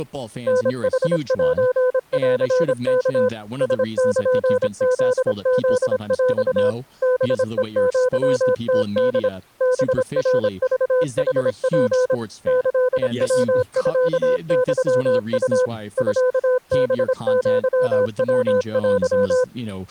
Morse code (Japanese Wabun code), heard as a keyed tone, machine-sent, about 26 wpm, 500 Hz, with speech in English. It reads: タヌセンワ ラルフフヰ ハヘアムホ ハナクヌツ キヤミユウ ミハアヤテ